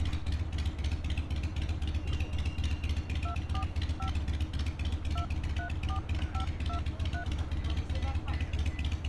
DTMF, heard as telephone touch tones, dialled by hand, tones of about 100 ms, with street noise. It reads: 245 234523